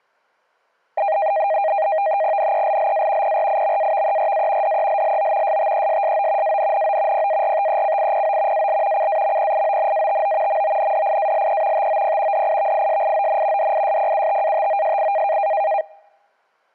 NAVTEX (SITOR-B), 100 baud, 170 Hz shift, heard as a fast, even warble, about 720 Hz centre. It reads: NELLA PRIMAVERA DELLO STESSO ANNO PARTECIPO AL CAMPIONATO MONDIALE TOP DIVISION DISPUTATOSI